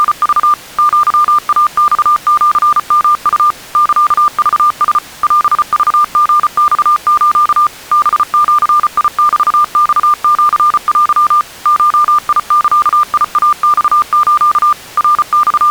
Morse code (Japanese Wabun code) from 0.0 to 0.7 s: …

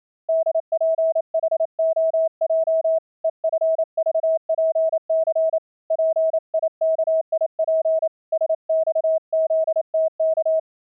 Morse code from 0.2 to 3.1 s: DPHOJ

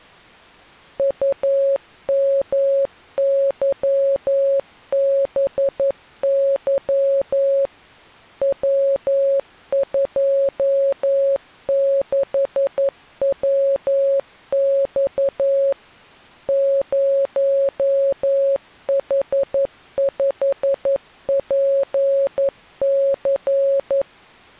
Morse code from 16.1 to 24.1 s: 0H5PC

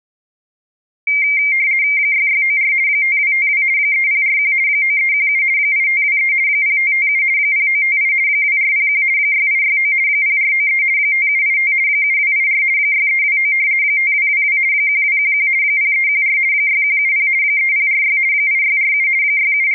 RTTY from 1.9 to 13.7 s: 6694 5252 3041 9317 8523 0557 0958 2401 6869 0493 5785 7284 6329

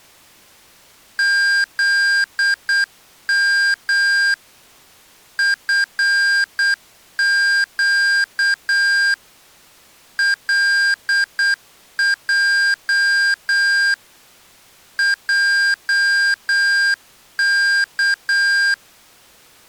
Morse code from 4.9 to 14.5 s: FQ LJ

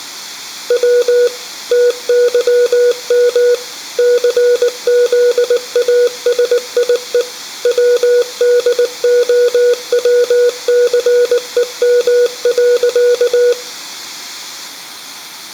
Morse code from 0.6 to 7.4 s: W TYM CZASIE

